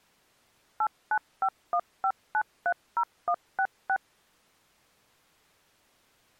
DTMF, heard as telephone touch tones, dialled by machine, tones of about 70 ms. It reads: 89515930166